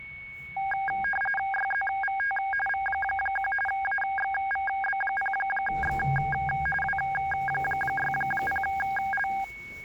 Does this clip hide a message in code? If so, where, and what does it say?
Yes: RTTY (45.45 baud, 850 Hz shift) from 0.6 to 9.4 s, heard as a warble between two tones, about 1200 Hz centre, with a steady whistle near 2220 Hz and the noise inside a lift. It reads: YZVT V1 AXVB0X W60L